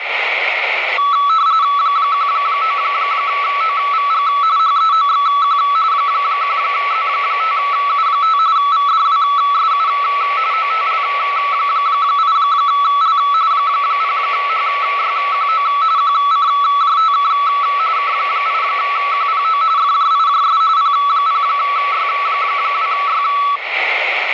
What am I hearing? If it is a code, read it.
RTTY (45.45 baud, 170 Hz shift), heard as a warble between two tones, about 1220 Hz centre, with radio static. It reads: 19OVG HEOXQ 1Z5U5 VDWSU OTL8L 0HYQO QCJTK K8QPO FJIJS P0Y2Y